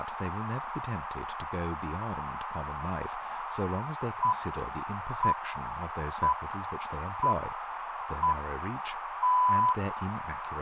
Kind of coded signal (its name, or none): radio time signal